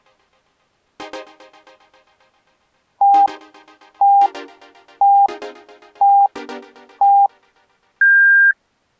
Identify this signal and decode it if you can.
Radio time signal (five pips and a higher one, as on Chinese radio), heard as pips.